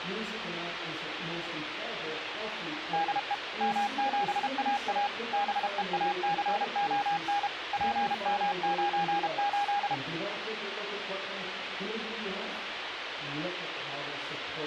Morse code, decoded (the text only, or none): DE M7AA BEACON PM98